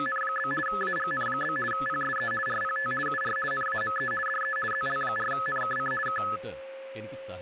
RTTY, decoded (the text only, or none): … AGN? PSE RPT UR NAME DE ZL4NKC K